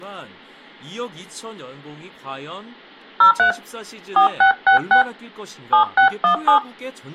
DTMF, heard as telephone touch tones, dialled by hand, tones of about 110 ms, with speech in Korean. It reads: 03 4666 7617